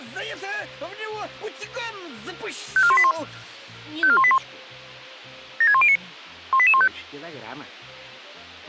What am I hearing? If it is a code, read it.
Five-tone selective call (ZVEI), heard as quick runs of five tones, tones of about 70 ms. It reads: 54181 54181 76109 18815